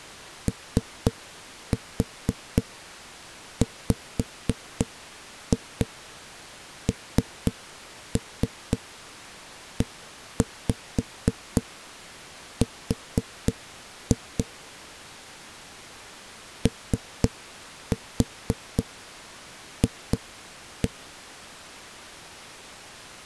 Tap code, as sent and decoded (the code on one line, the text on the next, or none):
3-4 5-2 3-3 1-5 4-2 / 3-4 2-1
OWNER OF